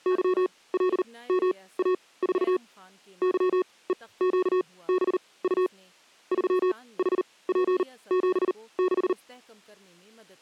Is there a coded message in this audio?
Yes: Morse code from 0.0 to 9.2 s, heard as electronic beeps, machine-sent, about 39 wpm, spaced as for 22 wpm, 370 Hz, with speech in Urdu. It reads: YLMA4 YEQBU 3HP76